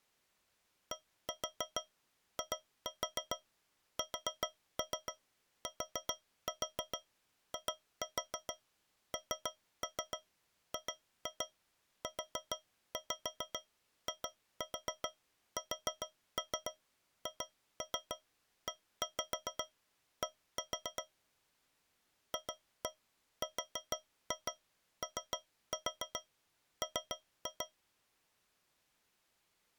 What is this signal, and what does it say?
Tap code, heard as taps on a metal pipe, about 7 knocks a second. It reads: DISTINGUISHED FROM